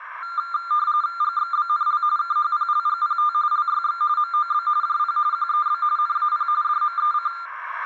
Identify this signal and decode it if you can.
RTTY (45.45 baud, 170 Hz shift), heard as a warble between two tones, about 1290 Hz centre, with radio static, a narrow filter and room echo. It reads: GXBNL KHPLGPT LYX MOB JP QEB NAP DMEC